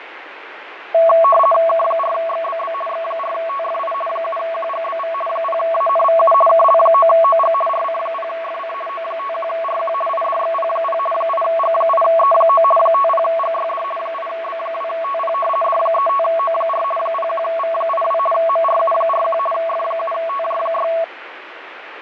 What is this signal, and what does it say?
RTTY (50 baud, 450 Hz shift), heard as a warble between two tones, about 890 Hz centre, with radio static and fading. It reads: K4XBB X4TFI 7QGBV 0ANVU KL9OG RC0FC O51RQ IDXP0 8G8E9 50GYD 8B2TP D35O4 01V82 MRU41 F7TJ6